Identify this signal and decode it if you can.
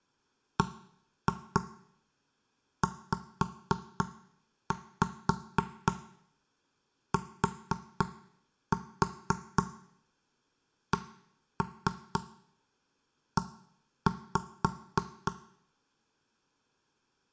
Tap code, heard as knocks on wood, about 4 knocks a second, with room echo. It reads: BZTCE